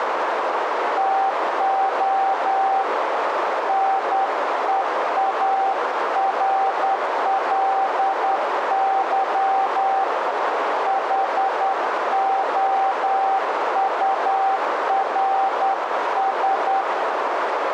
Morse code, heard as a keyed tone, hand-sent with a straight key, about 10 wpm, 780 Hz, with heavy radio static and a narrow filter. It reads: TO NEARLY HOURS